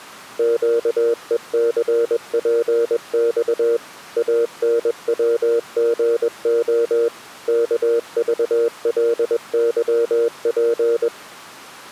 Morse code, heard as a keyed tone, machine-sent, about 21 wpm, 470 Hz. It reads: QECPX ANWGO KVLYP